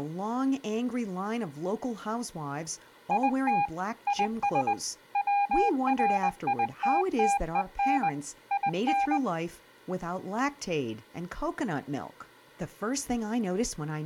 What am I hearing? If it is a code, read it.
Morse code, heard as a keyed tone, machine-sent, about 20 wpm, 810 Hz, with speech in English. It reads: IT IS WRITTEN IN